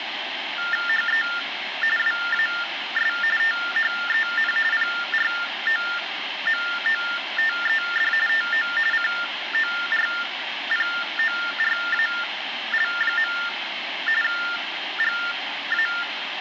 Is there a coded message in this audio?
Yes: TTY/TDD text telephone tones (45.45 baud Baudot) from 0.6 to 16.0 s, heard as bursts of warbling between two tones, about 400 Hz shift, 1600 Hz centre, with phone line noise. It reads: HE WAS THEN PROMOTED TO CORPORAL. GA